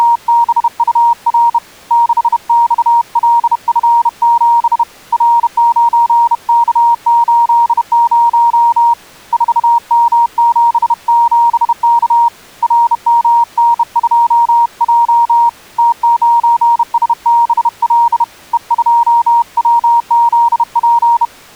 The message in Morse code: … 6XLF7 R9K80 4M77K RMN2J T9SBL E2WZP

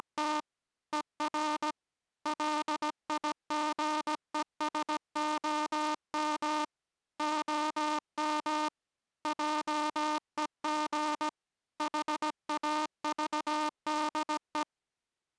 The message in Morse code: … ER LIGESOM OM JEG HAVDE

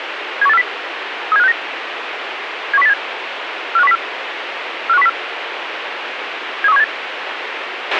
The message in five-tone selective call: 71840 37569 71087 45104 45104 73178

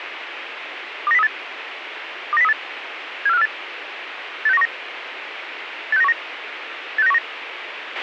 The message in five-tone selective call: 29038 29038 74548 86919 86919 86919

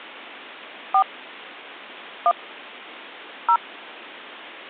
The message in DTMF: 4 1 0

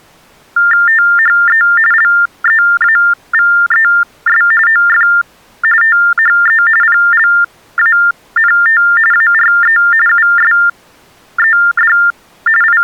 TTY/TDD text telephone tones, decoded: THE LEAVES OF THE PLANT ARE USED …

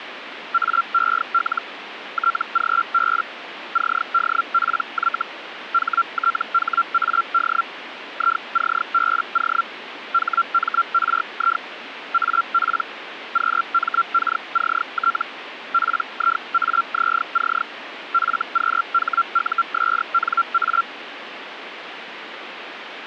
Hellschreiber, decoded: AEL TGB CDPY HTHAD ICBO HMRI AP QMKCT PIAZC FQHUSNA

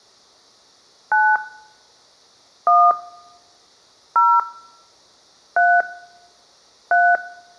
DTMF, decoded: 9 1 0 3 3

